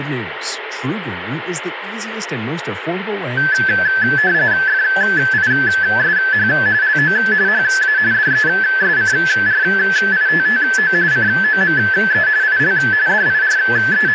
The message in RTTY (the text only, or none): FISH LO HA DESCRITTO COME IL …